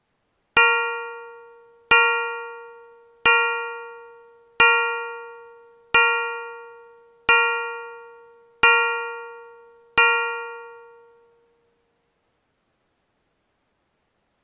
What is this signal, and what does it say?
Clock strike, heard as a bell. 8. Eight o'clock.